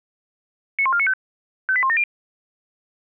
Five-tone selective call (ZVEI), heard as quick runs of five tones, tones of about 70 ms. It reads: 91495 58170